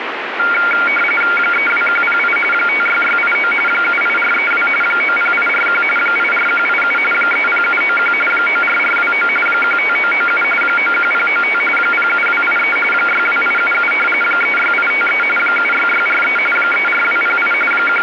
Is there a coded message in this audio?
Yes: RTTY (45.45 baud, 850 Hz shift) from 0.4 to 18.0 s, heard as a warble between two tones, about 1800 Hz centre, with radio static. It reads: 32108 56689 78432 90841 84187 30791 94429 15997 91095 07283 62877 36853 76643 34208 …